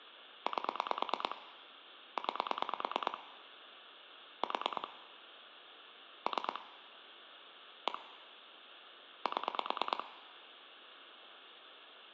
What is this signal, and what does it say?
Pulse dialling, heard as clicks on a phone line, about 9 pulses a second, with room echo. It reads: 8 9 4 3 1 7